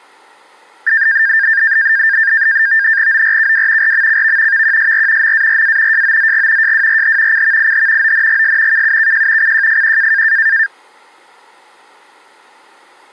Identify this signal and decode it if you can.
NAVTEX (SITOR-B), 100 baud, 170 Hz shift, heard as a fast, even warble, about 1700 Hz centre. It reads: ORKW RMCV VQSR MARA JOZG JWRH CVIH ONGS KUKJ CJFQ